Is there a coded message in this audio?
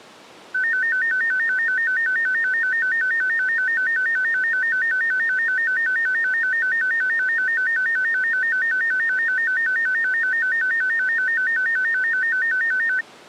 No, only a tone that alternates evenly between two pitches.